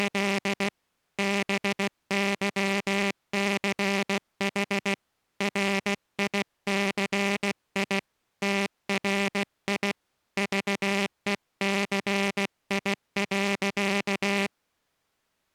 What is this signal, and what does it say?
Morse code, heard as a buzzer, hand-sent with a paddle, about 16 wpm. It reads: … BYCH RICI TRI VECI.